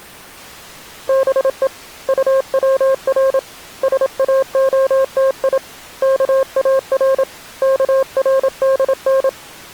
Morse code (Persian alphabet), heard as a keyed tone, hand-sent with a paddle, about 27 wpm, 530 Hz. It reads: به طور ساعتی کار کردن